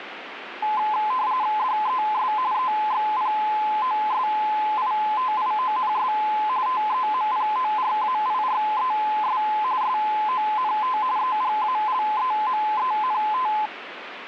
RTTY (45.45 baud, 170 Hz shift), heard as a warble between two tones, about 940 Hz centre, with radio static. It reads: DES EXPOSITIONS TEMPORAIRES SONT EGALEMENT